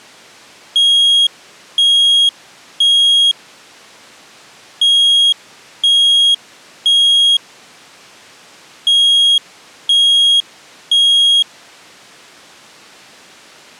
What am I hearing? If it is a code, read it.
Alarm pattern, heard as an alarm's beeps, played three times, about 3300 Hz. Temporal three. Smoke or fire, evacuate.